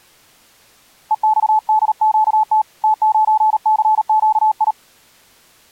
Morse code, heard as a keyed tone, hand-sent with a paddle, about 38 wpm, 860 Hz. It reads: EXDQT T9CQI